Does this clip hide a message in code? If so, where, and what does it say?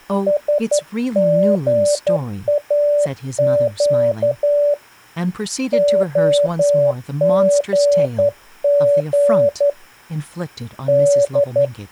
Yes: Morse code (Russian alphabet) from 0.2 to 11.7 s, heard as a keyed tone, hand-sent with a straight key, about 11 wpm, 580 Hz, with speech in English. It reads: СГАЩ ОГГ Д